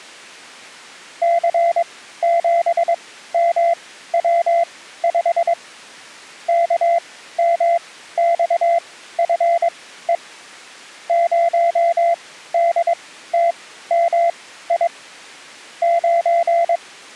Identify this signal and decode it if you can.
Morse code, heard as a keyed tone, machine-sent, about 22 wpm, spaced as for 14 wpm, 680 Hz. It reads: C7MW5 KMXFE 0DTMI …